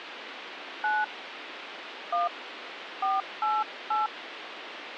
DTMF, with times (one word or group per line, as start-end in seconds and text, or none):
0.8-1.0 9
2.1-2.3 1
3.0-4.1 488